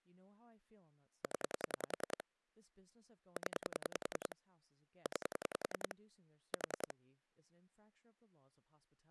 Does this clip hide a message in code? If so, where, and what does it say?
Yes: pulse dialling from 1.2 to 6.9 s, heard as clicks on a phone line, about 10 pulses a second, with speech in English. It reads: 0 0 9 4